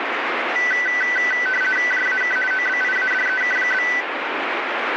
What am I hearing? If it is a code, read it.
RTTY (50 baud, 450 Hz shift), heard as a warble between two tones, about 1750 Hz centre, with radio static. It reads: JAK OBIADEK?